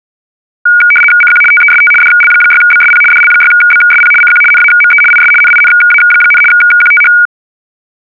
RTTY (75 baud, 850 Hz shift), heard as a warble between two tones, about 1850 Hz centre. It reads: CQ TEST DL6BSP DL6BSP CQ NAME IS NINA, QTH